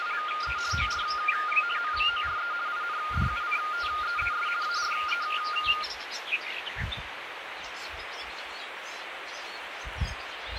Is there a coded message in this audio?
Yes: RTTY (50 baud, 170 Hz shift) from 0.0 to 5.8 s, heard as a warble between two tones, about 1320 Hz centre, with radio static. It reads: … OR MORE INDUCTEES ARE